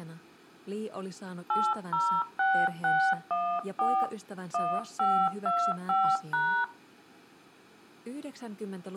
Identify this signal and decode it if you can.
DTMF, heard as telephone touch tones, dialled by hand, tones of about 280 ms, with room echo. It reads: 806614 1525#